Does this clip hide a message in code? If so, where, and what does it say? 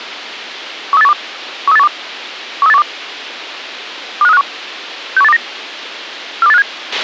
Yes: five-tone selective call (EEA) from 0.9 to 6.6 s, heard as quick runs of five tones, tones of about 40 ms, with a squelch burst at the end. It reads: 13812 13812 13812 25351 61829 42857